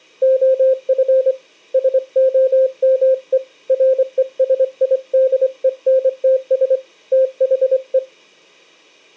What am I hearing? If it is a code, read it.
Morse code, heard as a keyed tone, hand-sent with a straight key, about 24 wpm, 520 Hz. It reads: OF SOME RESIDENTS THE